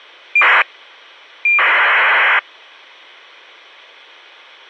ACARS aircraft data, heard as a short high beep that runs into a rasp, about 2400 baud.